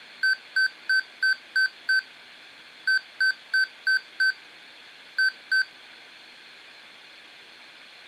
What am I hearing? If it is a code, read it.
Beep code, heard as beeps from a small speaker, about 1550 Hz. 6-5-2.